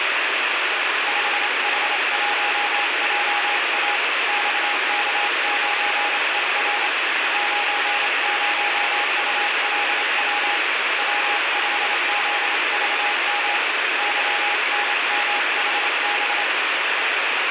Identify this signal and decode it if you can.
Morse code, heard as a keyed tone, hand-sent with a paddle, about 27 wpm, 820 Hz, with heavy radio static. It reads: 5H1JA XK9ER 90ULW W5ZVM YNMHB